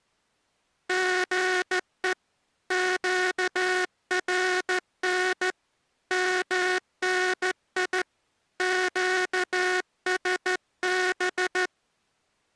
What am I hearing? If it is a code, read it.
Morse code, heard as a buzzer, hand-sent with a straight key, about 14 wpm. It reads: GE QRN MNI QSB